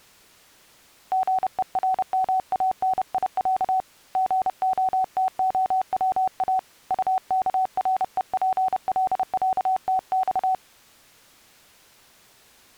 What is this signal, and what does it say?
Morse code (Russian alphabet), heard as a keyed tone, hand-sent with a paddle, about 30 wpm, 750 Hz. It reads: ГЕРМАНИЯ ГОТОВА УКРЕПЛЯТЬ